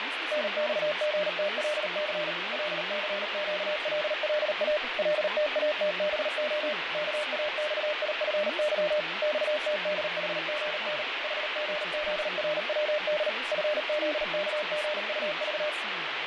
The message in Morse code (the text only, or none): NXGTLC LCQLLA LTATBO KAXIFY XTDHGN HGZRWD FZKGUV